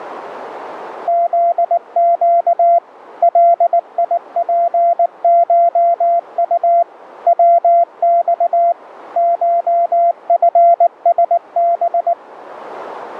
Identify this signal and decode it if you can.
Morse code (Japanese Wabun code), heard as a keyed tone, machine-sent, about 19 wpm, 690 Hz. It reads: フネ ガツコウ ヤマ コチラハ